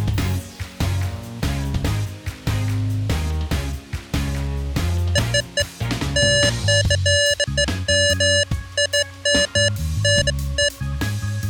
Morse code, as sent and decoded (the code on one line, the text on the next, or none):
none